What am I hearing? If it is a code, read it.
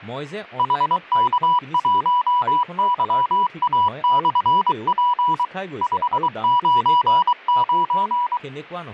Morse code, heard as a keyed tone, machine-sent, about 23 wpm, 980 Hz, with speech in Assamese. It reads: HK1YA/P 599